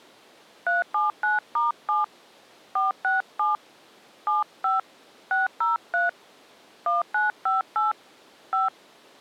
DTMF, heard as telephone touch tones, dialled by hand, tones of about 160 ms. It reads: 379*7 467 75 603 1958 5